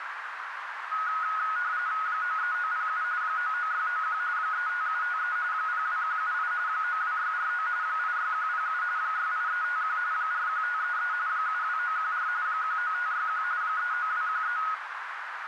RTTY (45.45 baud, 170 Hz shift), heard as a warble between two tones, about 1360 Hz centre, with radio static and a narrow filter. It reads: 93907 99691 35753 02178 92649 86107 68351 41533 72914 19561 39213